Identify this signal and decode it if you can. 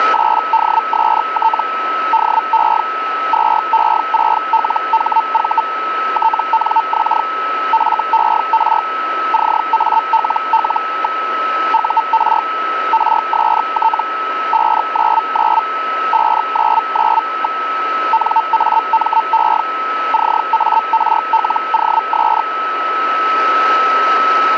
Hellschreiber (Feld-Hell, 122.5 baud), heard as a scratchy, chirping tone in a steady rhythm, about 900 Hz, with radio static and a steady whistle near 1300 Hz. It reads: … DE 2E6LHV TNX FER CALL. UR RST 599 599. NAME CARLOS